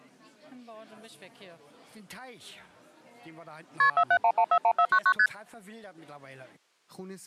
Multi-frequency trunk signalling (R1, as on North American trunks), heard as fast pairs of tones, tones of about 70 ms. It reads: KP 471141499 ST